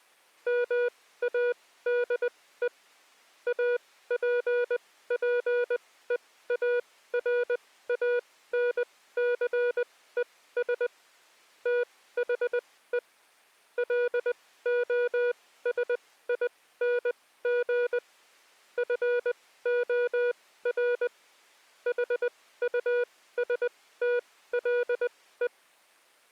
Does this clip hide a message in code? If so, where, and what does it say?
Yes: Morse code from 0.4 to 25.5 s, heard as a keyed tone, machine-sent, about 20 wpm, spaced as for 15 wpm, 480 Hz. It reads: MADE APPEARANCES THE LOSING FOR HUSTLE